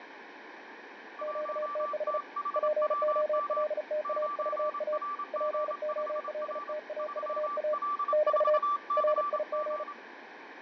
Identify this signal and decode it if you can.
Morse code, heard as two keyed tones, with radio static and fading. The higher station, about 27 wpm, 1170 Hz: 1THWM 9RG5R 3L4CG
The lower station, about 35 wpm, 610 Hz: QTH POLTAVA POLTAVA <BT> RIG